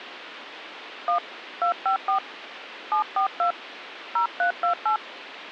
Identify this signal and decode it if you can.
DTMF, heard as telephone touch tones, dialled by hand, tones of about 100 ms, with phone line noise. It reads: 1 254 742 0328